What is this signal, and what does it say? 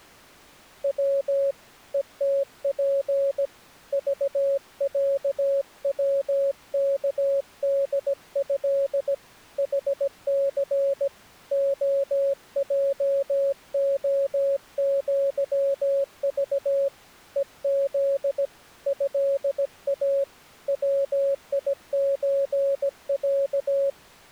Morse code (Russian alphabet), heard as a keyed tone, hand-sent with a paddle, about 17 wpm, 550 Hz. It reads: В ЕТП ЖЯВКДЭ ХЦ ОЙОЪЖ ЕЗ ЭА ВИЧЯ